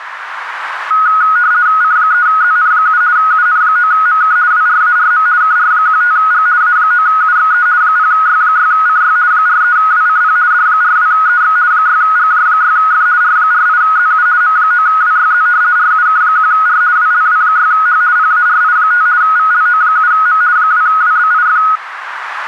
RTTY (50 baud, 170 Hz shift), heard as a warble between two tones, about 1360 Hz centre, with radio static. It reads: C3ZN7 UN9MK WRARM KR15G A9UXE 0Y6CY 43WCP D42EX 6GJ6F R48ZU M9WYZ RUK1R WLW6H PARI5 VLO7M 2WBIF